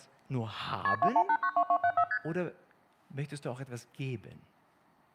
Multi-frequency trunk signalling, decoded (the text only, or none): KP 21892274 ST